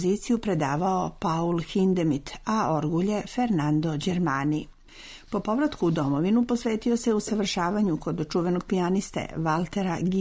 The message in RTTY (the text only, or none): none